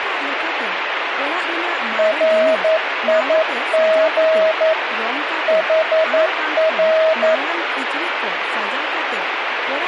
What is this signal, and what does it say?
Morse code, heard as a keyed tone, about 11 wpm, 640 Hz, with radio static and speech in Santali. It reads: RIG HR